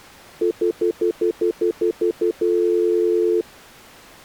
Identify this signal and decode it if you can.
Telephone call progress tone (North American plan), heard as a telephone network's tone, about 350, 440 Hz, 0.1 s on and 0.1 s off. Stutter dial tone.